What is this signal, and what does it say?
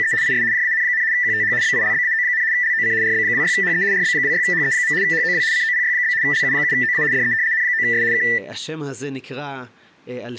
RTTY (75 baud, 170 Hz shift), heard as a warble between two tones, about 1900 Hz centre, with room echo and speech in Hebrew. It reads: … IS JAN, QTH BILBAO, LOC RB26HE RB26HE. HOW COPY? LU7OA DE N9S K